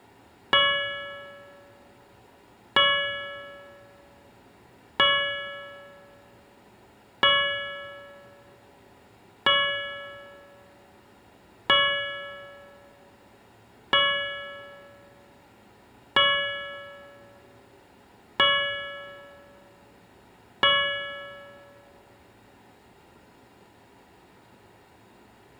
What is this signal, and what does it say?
Clock strike, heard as a bell, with room echo. 10. Ten o'clock.